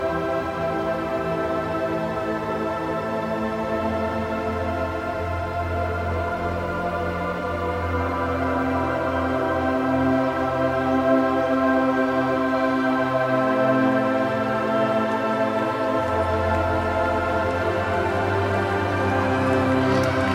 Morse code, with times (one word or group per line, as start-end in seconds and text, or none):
none